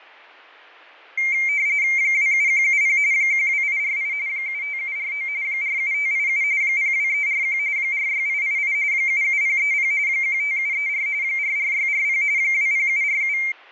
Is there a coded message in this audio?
Yes: RTTY (45.45 baud, 170 Hz shift) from 1.2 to 13.5 s, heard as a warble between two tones, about 2200 Hz centre, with fading. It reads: 27170 12848 75749 47587 02341 46888 77030 15734 44640 20747